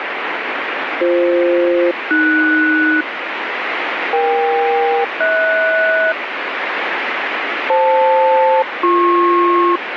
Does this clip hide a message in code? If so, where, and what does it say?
Yes: aircraft SELCAL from 1.0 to 9.8 s, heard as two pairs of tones, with radio static. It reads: BF-AS EK-HS FL-BP